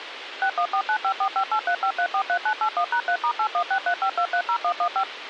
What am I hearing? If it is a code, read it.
DTMF, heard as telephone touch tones, dialled by machine, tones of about 80 ms, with radio hiss. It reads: 6149545835343981#3*81635230115